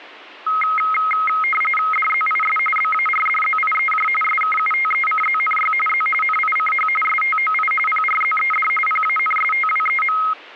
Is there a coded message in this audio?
Yes: RTTY (45.45 baud, 850 Hz shift) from 0.5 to 10.3 s, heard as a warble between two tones, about 1700 Hz centre. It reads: DZIS BARDZIEJ SKUTECZNY Z NICH STOI PRZED PANSTWEM